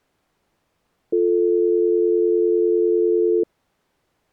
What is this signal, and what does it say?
Telephone call progress tone (North American or UK plan), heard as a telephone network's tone, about 350, 440 Hz. Dial tone.